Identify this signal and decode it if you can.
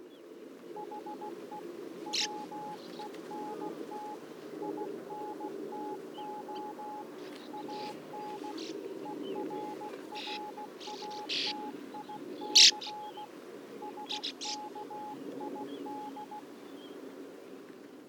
Morse code, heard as a keyed tone, hand-sent with a paddle, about 16 wpm, 840 Hz. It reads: HE WENT INTO AN ERRATIC SKID